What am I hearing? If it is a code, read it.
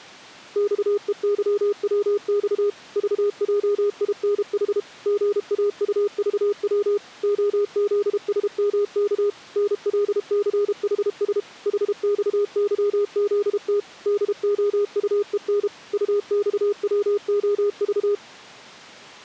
Morse code, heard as a keyed tone, machine-sent, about 32 wpm, 410 Hz. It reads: XEYWX VJINH GAUVW OZSMK NLCHS HXYZT DOUEN UXWOV